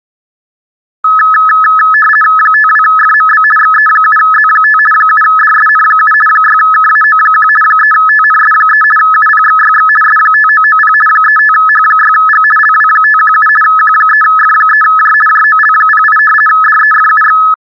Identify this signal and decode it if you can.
RTTY (50 baud, 450 Hz shift), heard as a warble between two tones, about 1500 Hz centre. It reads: 52FMB XE7Z5 7DSN7 6KAO1 3TNS3 UPXYX S5990 35H6G LW517 Q3F3J JOL08 DEFUX